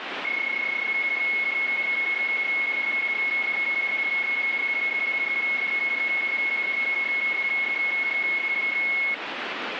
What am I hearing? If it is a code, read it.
PSK31 (31.25 baud), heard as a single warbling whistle, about 2200 Hz, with radio static.